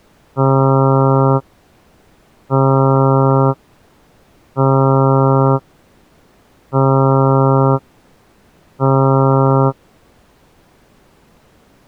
Ship horn signal, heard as a ship's horn, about 140 Hz. 5 short. At sea: I doubt that you are doing enough to avoid a collision.